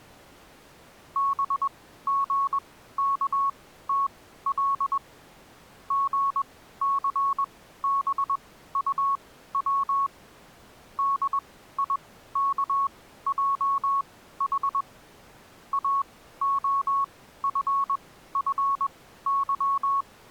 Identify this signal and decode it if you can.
Morse code, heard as a keyed tone, machine-sent, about 21 wpm, spaced as for 14 wpm, 1110 Hz. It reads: BGKTL GCBUW DIKJH AOFFY